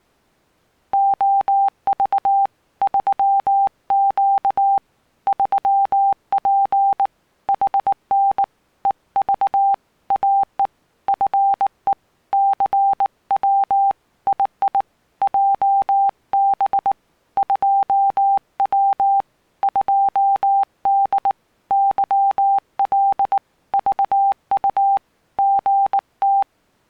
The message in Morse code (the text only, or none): OV 3Q 3P HN EV AE FE CW II JB 2W 2D YL VU GT